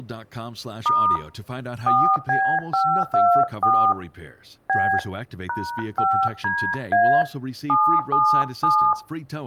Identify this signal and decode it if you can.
DTMF, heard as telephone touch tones, dialled by hand, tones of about 300 ms, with room echo and speech in English. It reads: * 4B524 B #5DA 777